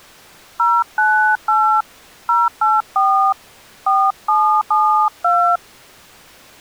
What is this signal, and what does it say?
DTMF, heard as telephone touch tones, dialled by hand, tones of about 290 ms. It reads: 098 084 4772